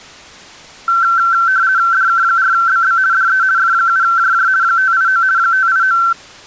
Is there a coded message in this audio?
Yes: RTTY (50 baud, 170 Hz shift) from 0.9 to 6.1 s, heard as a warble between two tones, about 1450 Hz centre. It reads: DK4BB DE F7JJ 589 589